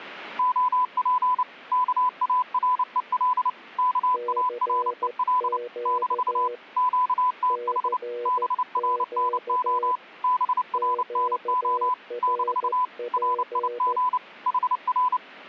Morse code, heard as two keyed tones. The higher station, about 29 wpm, 1000 Hz: OP KAREL KAREL - QTH BRNO BRNO - RIG HR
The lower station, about 14 wpm, 480 Hz: CQ CQ QRP